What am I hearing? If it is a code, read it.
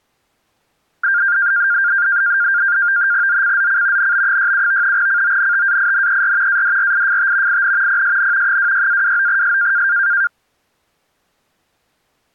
NAVTEX (SITOR-B), 100 baud, 170 Hz shift, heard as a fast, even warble, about 1500 Hz centre. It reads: ZCZC NB67 CONTAINER ADRIFT IN PSN 26-29S